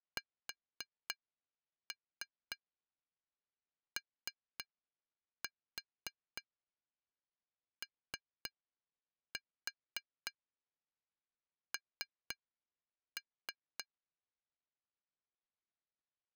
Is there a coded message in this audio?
Yes: tap code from 0.2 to 13.9 s, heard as taps on glass, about 3 knocks a second. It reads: SOON